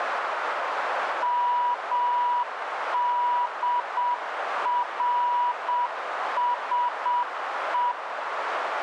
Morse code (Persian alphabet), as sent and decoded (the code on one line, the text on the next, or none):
-- -.. .-. ... .
مدرسه